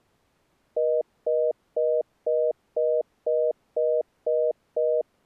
Telephone call progress tone (North American plan), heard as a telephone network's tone, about 480, 620 Hz, 0.25 s on and 0.25 s off. Congestion tone.